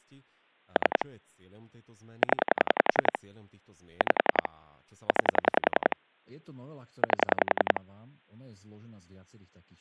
Pulse dialling, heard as clicks on a phone line, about 10 pulses a second, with speech in Slovak. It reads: 3 0 5 9 8